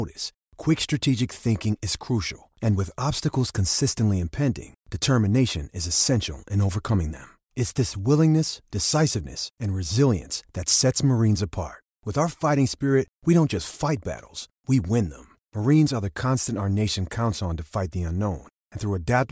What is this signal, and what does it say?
Speech in English. There is no code.